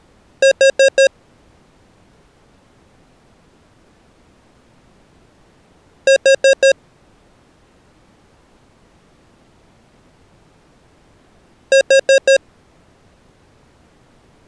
Alarm pattern, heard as an alarm's beeps, played three times, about 540 Hz. Temporal four. Carbon monoxide.